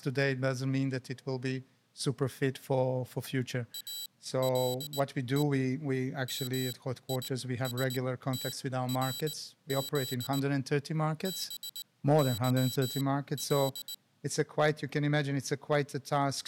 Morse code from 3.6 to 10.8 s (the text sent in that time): ALE MISTRZ